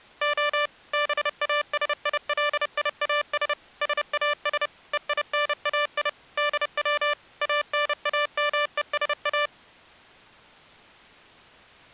Morse code (Greek alphabet), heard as electronic beeps, machine-sent, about 30 wpm, 590 Hz. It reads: Ο ΒΑΣΙΛΙΑΣ ΣΑΣ ΕΙΝΑΙ ΔΩ ΑΝΑΜΕΣΑ